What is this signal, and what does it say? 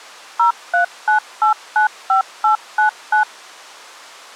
DTMF, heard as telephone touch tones, dialled by machine, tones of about 110 ms. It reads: 039895899